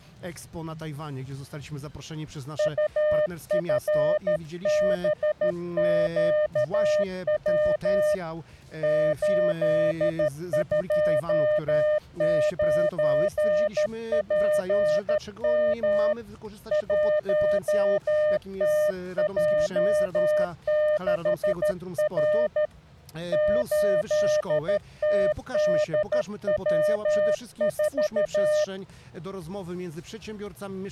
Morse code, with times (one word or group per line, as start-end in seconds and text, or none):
2.6-8.1 UFBQW
8.8-16.1 829PM
16.7-22.7 1TJ6R
23.3-28.6 8TDW4